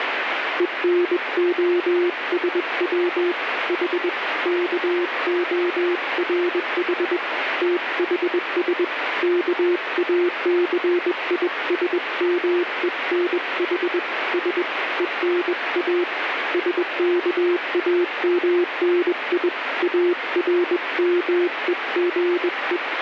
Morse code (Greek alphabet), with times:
0.6-3.3 ΕΝΟΣΩ
3.7-4.1 Η
4.5-7.2 ΚΟΡΗ
7.6-8.8 ΤΗΣ
9.2-14.0 ΚΑΘΙΣΜΕΝΗ
14.3-14.6 Σ
15.0-16.0 ΕΝΑ
16.5-19.5 ΣΚΑΜΝΙ
19.8-22.8 ΑΡΜΕΓΕ

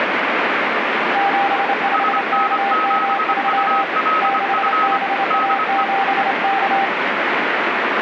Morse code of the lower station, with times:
1.2-3.8 75KM3
4.2-6.8 6BA7K

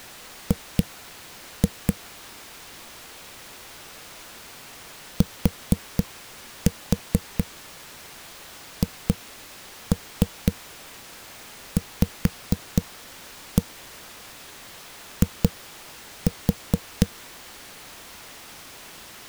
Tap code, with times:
0.5-1.9 G
5.2-17.1 THVI

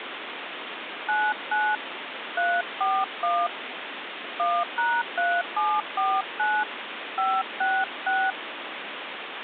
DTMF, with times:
1.1-1.8 99
2.4-3.5 341
4.4-6.6 1#3749
7.2-8.3 566

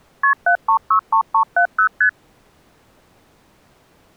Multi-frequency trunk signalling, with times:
0.2-0.3 KP
0.5-1.9 7363370
2.0-2.1 ST

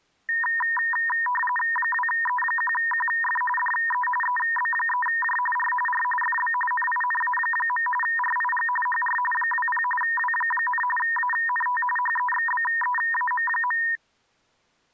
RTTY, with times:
1.8-3.4 2E1QF
3.6-4.1 DE
4.2-5.4 EB3J
5.6-5.7 R
5.9-6.0 R
6.2-6.5 FB
6.7-7.9 NINA.
8.0-8.7 RIG
8.9-9.2 HR
9.3-9.8 20
10.0-10.8 W,
11.0-11.8 ANT
12.0-13.8 HEXBEAM.

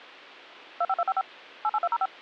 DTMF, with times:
0.8-1.2 25255
1.6-2.1 88205

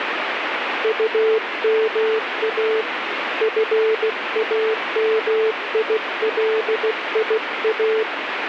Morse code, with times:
0.8-2.8 UMA
3.4-8.0 FAMILIA

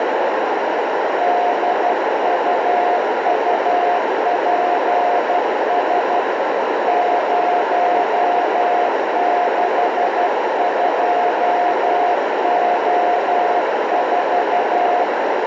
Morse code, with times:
1.2-6.2 DUUPS
6.9-15.0 062O4

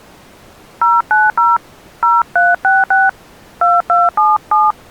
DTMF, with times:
0.8-1.6 090
2.0-3.1 0366
3.6-4.7 2277

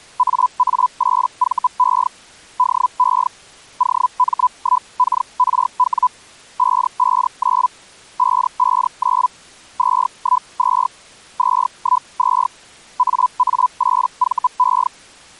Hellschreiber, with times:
0.2-2.1 AA8VE
2.6-3.3 DE
3.8-6.1 OM1KRW
6.6-7.7 559
8.2-9.3 559
9.8-10.9 212
11.4-12.5 212
13.0-14.9 AA8VE

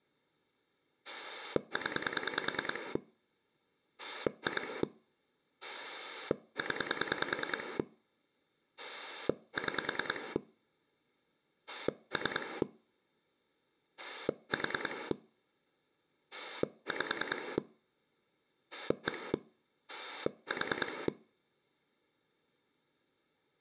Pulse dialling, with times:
1.0-3.0 0
4.0-4.8 2
5.6-7.8 0
8.8-10.4 6
11.7-12.6 3
14.0-15.1 4
16.3-17.6 5
18.7-19.3 1
19.9-21.1 4

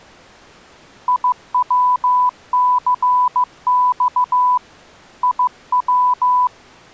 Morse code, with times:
1.1-4.6 IWCX
5.2-6.5 IW

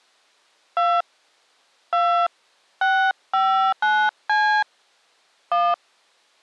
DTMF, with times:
0.8-1.0 2
1.9-2.3 2
2.8-4.6 659C
5.5-5.7 1

